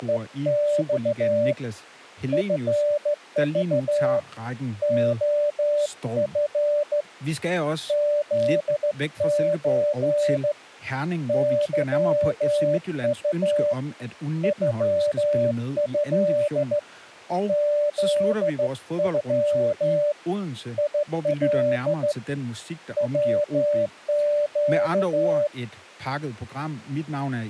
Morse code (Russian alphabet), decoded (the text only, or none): … ФЖ ОФ ЗЧ ЫУ ЮЭ ЗЮ ИЛ ВЩ